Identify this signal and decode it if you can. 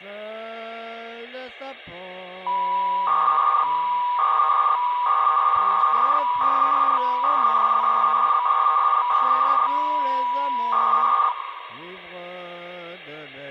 300-baud modem data (V.21 tones), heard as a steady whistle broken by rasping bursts, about 300 baud, 200 Hz shift, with hum.